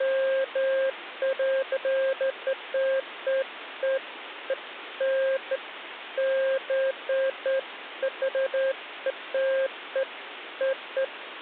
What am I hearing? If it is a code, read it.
Beeps of irregular length, with phone line noise. There is no code.